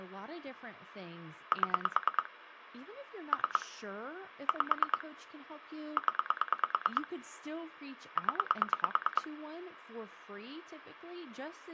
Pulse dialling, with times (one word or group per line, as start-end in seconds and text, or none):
1.5-2.3 7
3.3-3.7 3
4.5-5.0 5
6.0-7.1 0
8.2-9.3 0